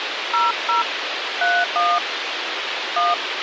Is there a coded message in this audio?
Yes: DTMF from 0.3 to 3.1 s, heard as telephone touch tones, dialled by hand, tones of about 190 ms, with radio hiss. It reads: 00 31 1